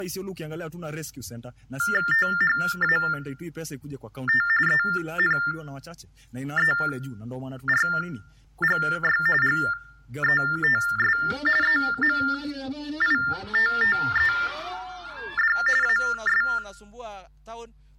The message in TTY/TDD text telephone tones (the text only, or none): THAT ENERGY GETS EMITTED AS